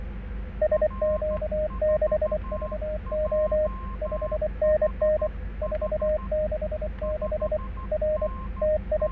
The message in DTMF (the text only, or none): none